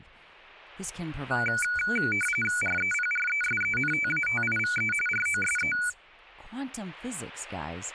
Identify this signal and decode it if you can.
RTTY (45.45 baud, 850 Hz shift), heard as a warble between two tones, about 1900 Hz centre, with speech in English. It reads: REPRESENTATIVE ROSE